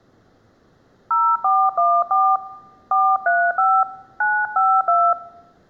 DTMF, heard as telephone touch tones, dialled by hand, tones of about 250 ms. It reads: 0414 435 952